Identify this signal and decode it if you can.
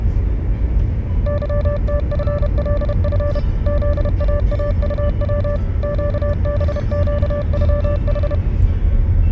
Morse code (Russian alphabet), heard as a keyed tone, machine-sent, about 31 wpm, 580 Hz, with the noise inside a car. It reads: ЫТФЛФ ЗААУВ ЩБЩЮХ